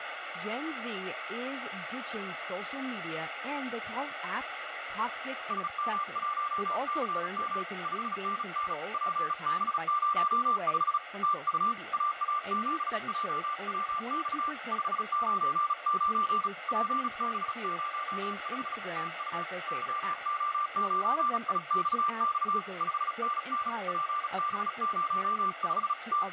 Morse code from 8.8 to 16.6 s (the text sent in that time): PB05 TU AA7JWX 599